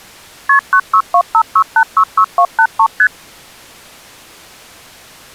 Multi-frequency trunk signalling (R1, as on North American trunks), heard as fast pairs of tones, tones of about 70 ms. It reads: KP 96256866283 ST